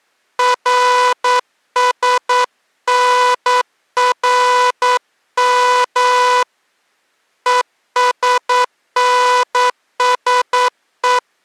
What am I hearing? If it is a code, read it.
Morse code, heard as a buzzer, hand-sent with a paddle, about 9 wpm. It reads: RSNRM ESNSE